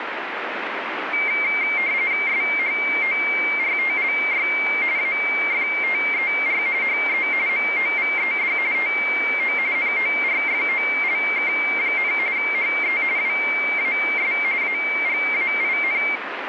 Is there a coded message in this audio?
Yes: RTTY (45.45 baud, 170 Hz shift) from 1.1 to 16.2 s, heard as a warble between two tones, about 2200 Hz centre, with radio static. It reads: SHORTLY AFTER HE MOVED TO NORFOLK, HE WAS AGAIN